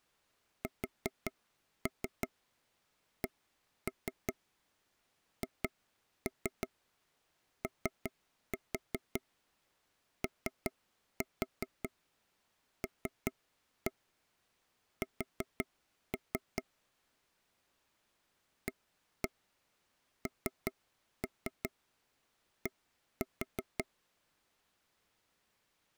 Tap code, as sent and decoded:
4-3 1-3 2-3 3-4 3-4 3-1 4-3 / 1-1 3-3 1-4
SCHOOLS AND

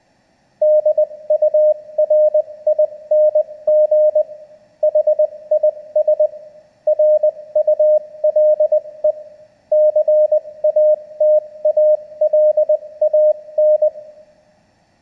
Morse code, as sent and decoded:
-.. ..- .-. .. -. --. / .... .. ... / .-. ..- .-.. . / -.-. .- - .- .-.. .- -.
DURING HIS RULE CATALAN

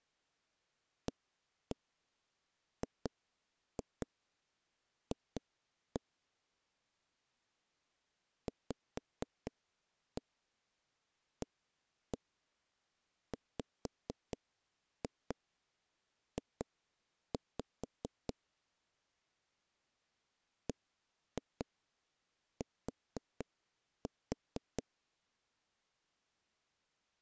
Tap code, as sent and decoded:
1-1 2-2 2-1 / 5-1 1-1 5-2 2-5 / 1-2 4-4
AGF VAWJ BT

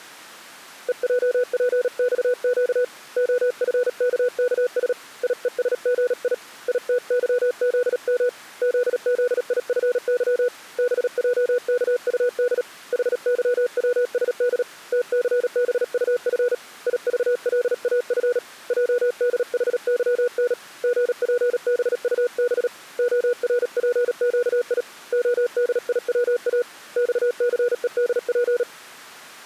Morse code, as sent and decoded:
. .--- .--. -..- --.- / --- ..-. -.- -.- ... / .. . ... --. .. / .. - -.-- --.. -- / --.. --.. .. ..-. -.-- / -... .--- -.- ..- -.. / .... -.-- .-- ... -.. / - -.-. -... ..- ..-. / .. ...- .-.. .- ..-. / .--- -.. .... -.-- -. / --. .--. -... ..- -... / --- .-. .--. --.- .. / --- -.. .. .-- .- / -..- -.-. . -.. .--.
EJPXQ OFKKS IESGI ITYZM ZZIFY BJKUD HYWSD TCBUF IVLAF JDHYN GPBUB ORPQI ODIWA XCEDP

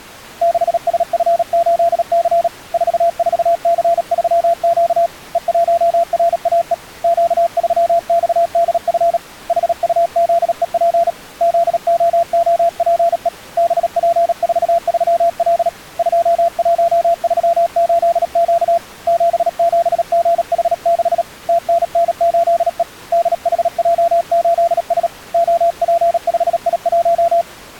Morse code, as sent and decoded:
-.... ... ..-. ---.. -.-. / ....- ....- -.-. ...-- --.- / . .---- .-. .- . / --.- ...-- -..- -.. ..-. / .... ..- --.. . .--. / --.. --- --- .--. . / -... .--. ....- ...-- .-.. / ..--- .---- ...-- ---.. --.- / --... --... --. .... -.... / - -. -. ---.. . / -.. .... .--- ---.. ... / --- .--. ..... .. .----
6SF8C 44C3Q E1RAE Q3XDF HUZEP ZOOPE BP43L 2138Q 77GH6 TNN8E DHJ8S OP5I1

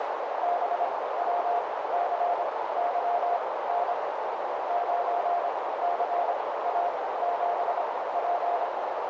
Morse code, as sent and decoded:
-... .-- -.-. -.-- -. / ----. -.-. .- --... .--.
BWCYN 9CA7P

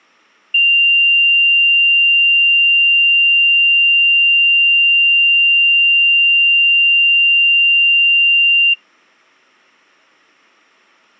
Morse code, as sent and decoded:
none

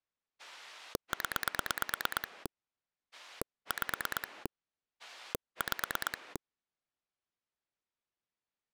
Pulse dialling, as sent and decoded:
10 / 5 / 5
0 5 5

